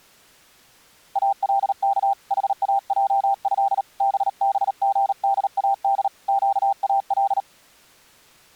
Morse code (Arabic alphabet), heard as a keyed tone, hand-sent with a paddle, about 38 wpm, 790 Hz. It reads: الك حاجه ببغداد قال